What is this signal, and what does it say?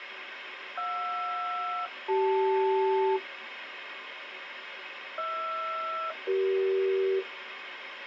Aircraft SELCAL, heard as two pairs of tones, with radio hiss. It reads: JR-CL HR-CE